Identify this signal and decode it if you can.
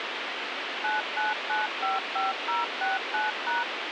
DTMF, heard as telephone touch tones, dialled by machine, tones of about 160 ms, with radio hiss. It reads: 99955069#